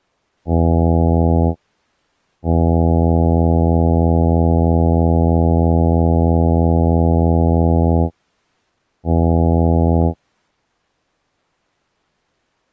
Ship horn signal, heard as a ship's horn, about 80 Hz. 1 short, 1 long, 1 short. At sea: a vessel at anchor warns of its position.